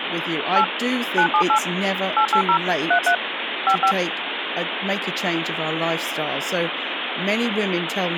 DTMF, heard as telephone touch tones, dialled by machine, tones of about 90 ms, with phone line noise and speech in English. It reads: 8 978 880 33 55